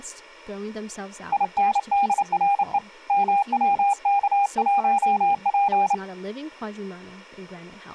Morse code, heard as a keyed tone, hand-sent with a paddle, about 29 wpm, 800 Hz, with speech in English. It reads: INDRE MWK1P